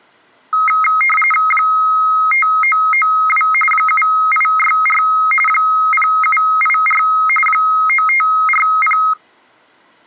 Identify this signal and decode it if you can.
RTTY (45.45 baud, 850 Hz shift), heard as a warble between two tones, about 1700 Hz centre. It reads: 5992 7864 0784 9540